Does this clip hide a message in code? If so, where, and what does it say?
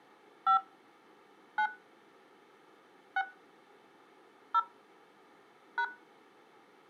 Yes: DTMF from 0.5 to 5.8 s, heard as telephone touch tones, dialled by hand, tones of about 80 ms. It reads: 5 9 6 0 #